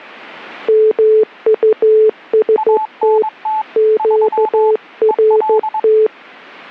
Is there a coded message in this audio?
Yes: Morse code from 0.6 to 6.1 s, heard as two keyed tones. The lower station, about 14 wpm, 430 Hz: MUST QRT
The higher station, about 22 wpm, 870 Hz: ANT 3 EL